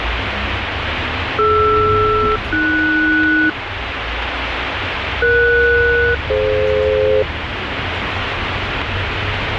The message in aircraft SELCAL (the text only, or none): DR-AS ES-DF